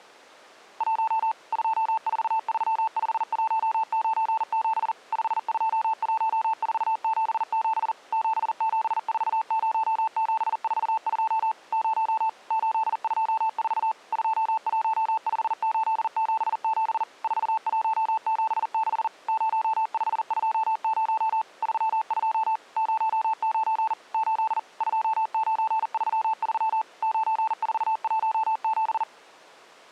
Morse code, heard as a keyed tone, machine-sent, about 40 wpm, 880 Hz. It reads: 1 2435197 521477 7740742 0 824 215877 4176 0520 32 09 8 2933 9417